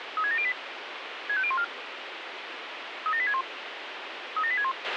Five-tone selective call (ZVEI), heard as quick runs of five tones, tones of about 70 ms, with radio hiss and a squelch burst at the end. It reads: 36708 65014 37861 37861